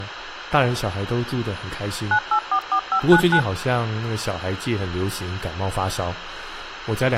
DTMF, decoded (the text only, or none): 9844599